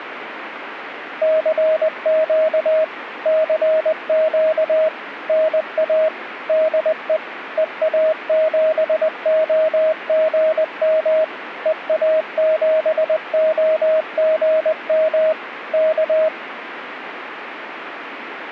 Morse code, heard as a keyed tone, machine-sent, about 20 wpm, 630 Hz, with radio static. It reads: CQ CQ NA DE EA7OGM EA7OGM K